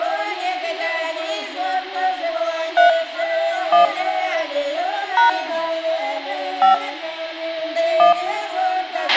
DTMF, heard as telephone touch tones, dialled by hand, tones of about 130 ms, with a squelch burst at the end. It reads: 3 1 # 5 1